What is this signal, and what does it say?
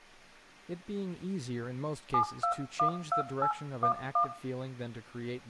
DTMF, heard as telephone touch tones, dialled by hand, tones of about 100 ms, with speech in English. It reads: 7212811